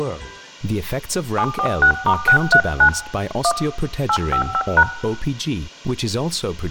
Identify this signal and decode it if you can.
DTMF, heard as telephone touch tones, dialled by hand, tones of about 80 ms, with room echo. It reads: 746*639 1 855#